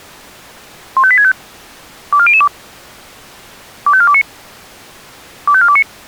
Five-tone selective call (ZVEI), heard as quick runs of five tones, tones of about 70 ms. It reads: 15865 24002 25429 25429